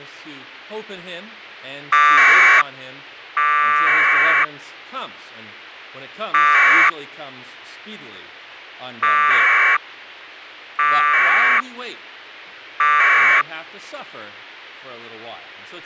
Packet radio (AX.25, as in APRS), 1200 baud, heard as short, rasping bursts.